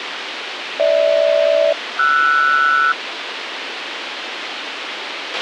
Aircraft SELCAL, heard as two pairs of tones, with radio hiss and a squelch burst at the end. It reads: GH-RS